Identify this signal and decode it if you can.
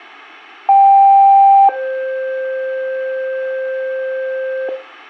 Two-tone page, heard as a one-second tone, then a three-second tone, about 790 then 520 Hz, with room echo.